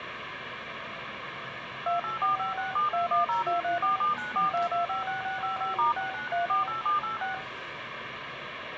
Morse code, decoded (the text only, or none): none